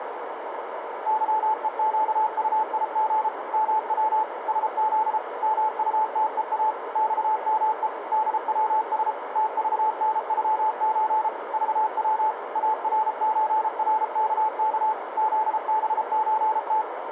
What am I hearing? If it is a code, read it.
Morse code (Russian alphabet), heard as a keyed tone, machine-sent, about 33 wpm, 870 Hz, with radio static and a narrow filter. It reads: ЫЕЩУИГ МВ СЗ МУТЕА ЬМЕ ДВС ТЖНЮЧ ЖВ АРЧРКК ЗБЧТ